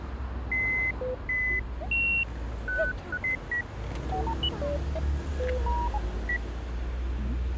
Electronic bleeps of random pitch and length, with street noise. There is no code.